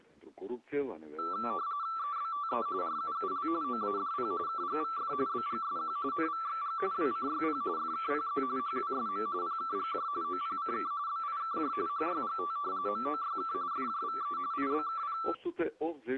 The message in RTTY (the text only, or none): EBTE RUUL OADP KGVF BGSQ NVXG WCYP FKPZ HWSM PKGJ OPCK BIKJ HYGT MOYK FJVE IBKP